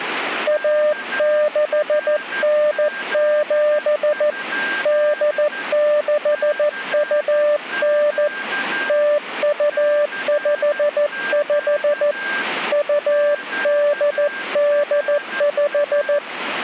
Morse code (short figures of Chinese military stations), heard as a keyed tone, hand-sent with a paddle, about 14 wpm, 590 Hz, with a weaker station near 1590 Hz. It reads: 1697 8629 0255 2885